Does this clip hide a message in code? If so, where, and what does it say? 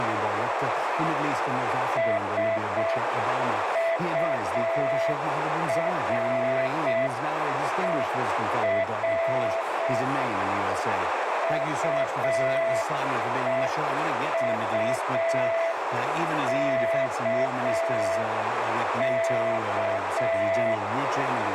Yes: Morse code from 1.9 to 20.8 s, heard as a keyed tone, hand-sent with a paddle, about 6 wpm, 660 Hz, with heavy radio static and a narrow filter. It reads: SURER UEUKK